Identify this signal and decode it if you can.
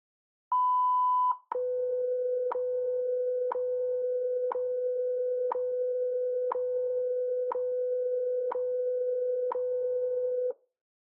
Radio time signal (WWV, Colorado), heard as ticks, one a second.